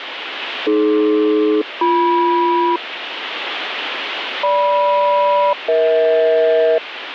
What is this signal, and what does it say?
Aircraft SELCAL, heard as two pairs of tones, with radio static. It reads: AD-BM GM-EH